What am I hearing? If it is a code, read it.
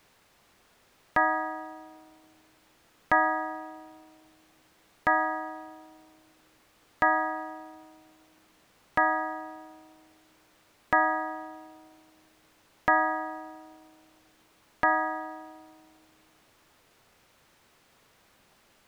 Clock strike, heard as a bell. 8. Eight o'clock.